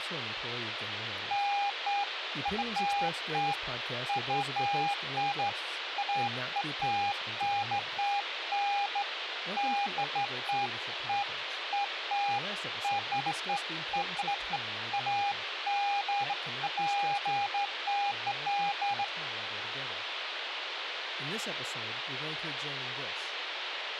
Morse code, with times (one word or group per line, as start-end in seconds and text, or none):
none